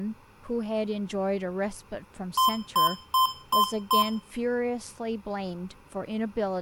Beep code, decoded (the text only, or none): 5 short